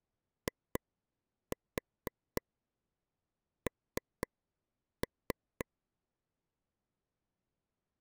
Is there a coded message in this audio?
Yes: tap code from 0.5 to 5.6 s, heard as taps on a table, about 4 knocks a second. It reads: IN